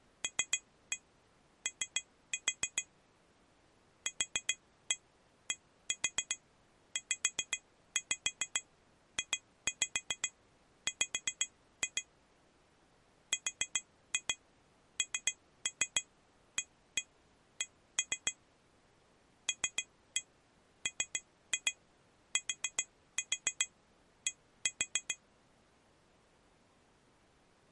Tap code, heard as taps on glass, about 7 knocks a second. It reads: LO QDZJW RNAC LMTD